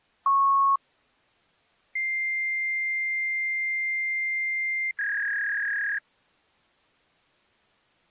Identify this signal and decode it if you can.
Fax machine handshake, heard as a beep, a long tone and a warble.